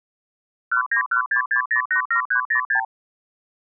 Multi-frequency trunk signalling (R2, with the far end's replies), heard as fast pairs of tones, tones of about 100 ms. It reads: 19166087306